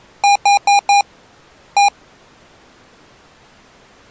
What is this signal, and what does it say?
Beep code, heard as beeps from a small speaker, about 810 Hz. 4-1.